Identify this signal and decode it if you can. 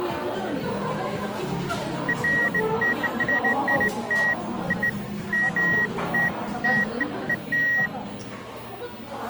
Beeps of irregular length, with the noise of a crowd indoors. There is no code.